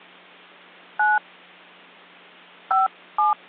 DTMF, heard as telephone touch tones, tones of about 170 ms. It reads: 9 57